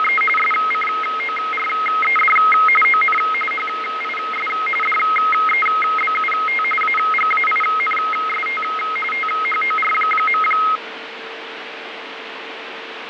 RTTY (45.45 baud, 850 Hz shift), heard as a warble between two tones, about 1700 Hz centre, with radio static and fading. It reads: … SCORED ON HIS DEBUT AGAINST THOR.